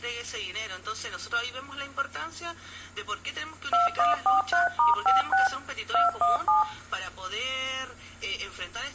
DTMF, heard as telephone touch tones, dialled by machine, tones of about 150 ms, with room echo. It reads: 2143*56 217